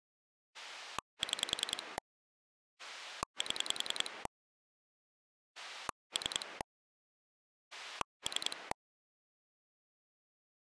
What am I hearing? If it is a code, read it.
Pulse dialling, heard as a rotary dial, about 10 pulses a second. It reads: 6 7 3 3